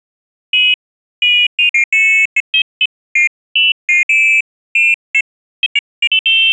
Pairs of high tones at irregular times. There is no code.